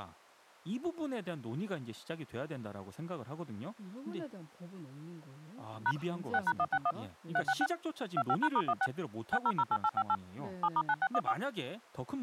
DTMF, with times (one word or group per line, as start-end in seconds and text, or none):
5.9-5.9 #
6.3-6.9 6#161
7.4-7.7 366
8.2-8.9 25#*16
9.3-10.2 6008858
10.6-11.3 7*9614